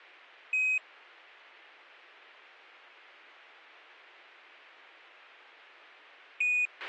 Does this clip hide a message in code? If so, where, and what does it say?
Yes: Quindar tones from 0.5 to 6.7 s, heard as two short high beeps, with a squelch burst at the end.